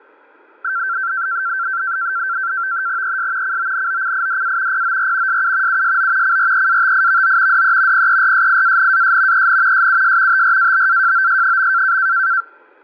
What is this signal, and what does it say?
NAVTEX (SITOR-B), 100 baud, 170 Hz shift, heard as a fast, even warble, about 1460 Hz centre, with fading. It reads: ES CONOCIDA POR SU USO CREATIVO DE PERSIANAS EN SUS TRABAJOS.